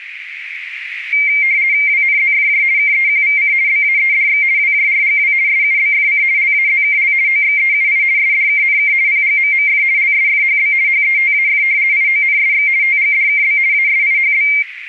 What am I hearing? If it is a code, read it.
RTTY (50 baud, 170 Hz shift), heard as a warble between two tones, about 2200 Hz centre, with radio static and a narrow filter. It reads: WNZFJ KEQVC BAEDX WJRGW SUBFC LAZKL OXEUI SDKNK PGMMF LSFHB HETAF IONSX TGDKB ASIHB